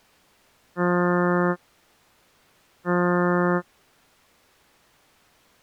Ship horn signal, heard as a ship's horn, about 180 Hz. 2 short. At sea: I am altering course to port.